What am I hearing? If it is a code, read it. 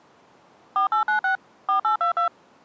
DTMF, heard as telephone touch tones, dialled by machine, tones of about 110 ms. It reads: 4896 4822